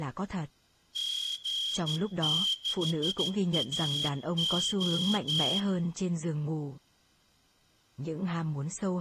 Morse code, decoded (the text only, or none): G6AO